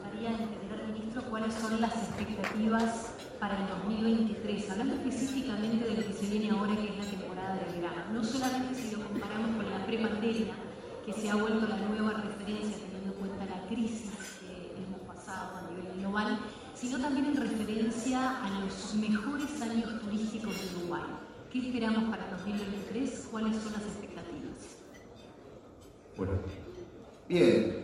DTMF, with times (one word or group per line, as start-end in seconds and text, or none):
none